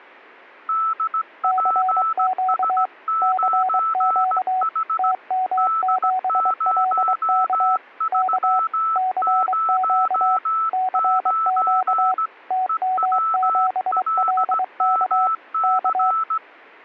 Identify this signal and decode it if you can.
Morse code, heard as two keyed tones. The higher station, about 17 wpm, 1320 Hz: DPS9H D0309 EWLMC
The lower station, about 23 wpm, 750 Hz: CQ CQ TM7LK K CQ CQ TM7LK K